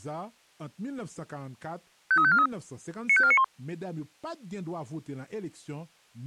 Five-tone selective call (ZVEI), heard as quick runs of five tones, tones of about 70 ms, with speech. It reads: 53543 95491